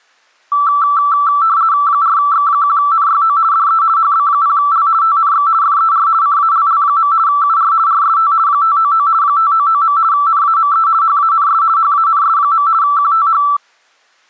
RTTY (50 baud, 170 Hz shift), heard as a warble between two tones, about 1240 Hz centre. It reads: 4X1NYO DE HB0L TNX FER CALL. UR RST 599 599. NAME HANS HANS. QTH